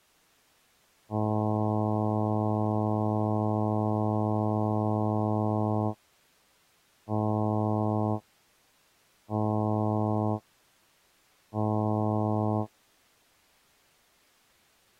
Ship horn signal, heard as a ship's horn, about 110 Hz. 1 long, 3 short. At sea: a vessel under tow in fog.